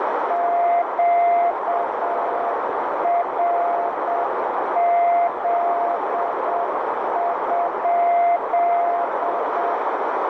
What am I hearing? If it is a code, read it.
Morse code, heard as a keyed tone, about 7 wpm, 690 Hz, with heavy radio static and a narrow filter. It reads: QRZ?